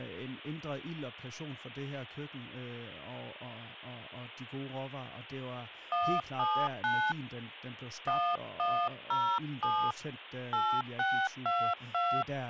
DTMF, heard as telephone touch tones, dialled by hand, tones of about 280 ms, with speech in Danish. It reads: 179 1107 8622